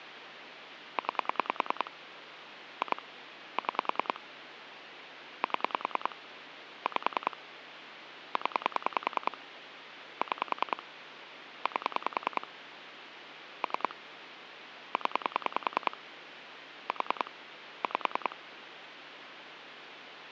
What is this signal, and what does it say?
Pulse dialling, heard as clicks on a phone line, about 10 pulses a second, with phone line noise. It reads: 9 2 6 7 5 0 6 8 3 0 4 5